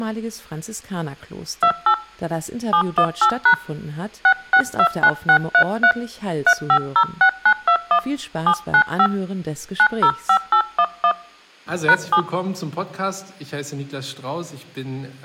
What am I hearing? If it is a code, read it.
DTMF, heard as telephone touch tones, dialled by hand, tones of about 80 ms. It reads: 28 718# 6629633 3506921 795 905811 #7